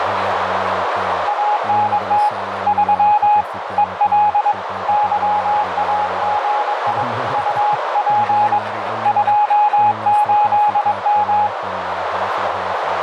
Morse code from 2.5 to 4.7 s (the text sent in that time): 3 EL